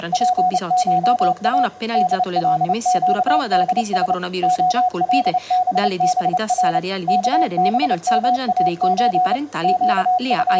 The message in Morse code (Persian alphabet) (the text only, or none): … دلگدس علببر کبماچ …